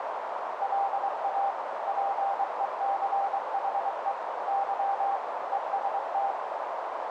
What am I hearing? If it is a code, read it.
Morse code, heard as a keyed tone, machine-sent, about 23 wpm, 790 Hz, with heavy radio static and a narrow filter. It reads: LA PECHE Y EST